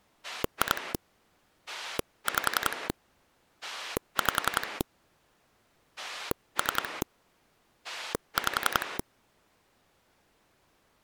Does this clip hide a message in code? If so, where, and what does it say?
Yes: pulse dialling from 0.2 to 9.0 s, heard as a rotary dial, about 11 pulses a second. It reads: 2 5 5 3 5